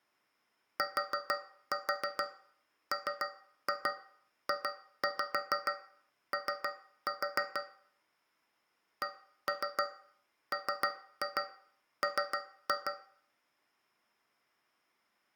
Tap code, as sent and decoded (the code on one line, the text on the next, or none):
4-4 3-2 2-5 3-4 / 1-3 3-2 3-2
TMJO CMM